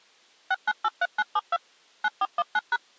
DTMF, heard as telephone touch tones, dialled by machine, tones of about 40 ms. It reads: 6983972 9419#